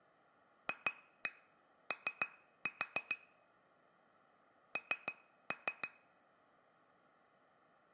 Tap code, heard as taps on glass, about 6 knocks a second. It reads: FO N